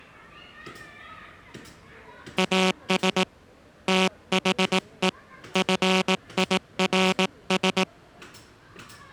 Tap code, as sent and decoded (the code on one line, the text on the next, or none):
none